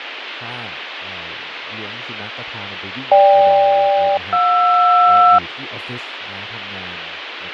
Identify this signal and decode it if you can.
Aircraft SELCAL, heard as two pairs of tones, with radio static and speech in Thai. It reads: GK-JR